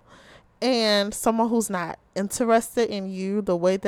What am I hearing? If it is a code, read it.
Speech in English. There is no code.